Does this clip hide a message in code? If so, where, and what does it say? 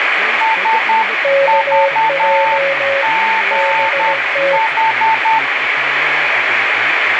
Yes: Morse code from 0.4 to 5.4 s, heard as two keyed tones, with radio static, room echo and speech in Kashmiri. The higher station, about 10 wpm, 890 Hz: SVGH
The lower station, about 17 wpm, 550 Hz: KJ BT